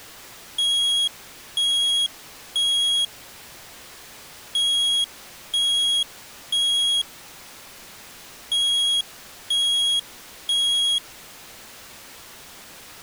Alarm pattern, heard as an alarm's beeps, played three times, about 3300 Hz. Temporal three. Smoke or fire, evacuate.